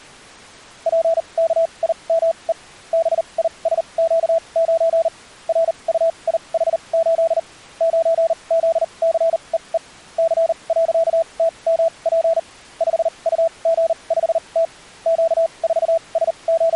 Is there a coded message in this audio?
Yes: Morse code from 0.8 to 16.8 s, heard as a keyed tone, machine-sent, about 39 wpm, spaced as for 29 wpm, 660 Hz. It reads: PKIME BISQ9 RUIH8 9ZCEE C.TMP 5UG5T …